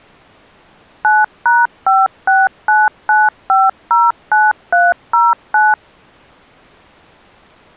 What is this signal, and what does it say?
DTMF, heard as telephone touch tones, dialled by machine, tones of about 200 ms. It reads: 9#5699509309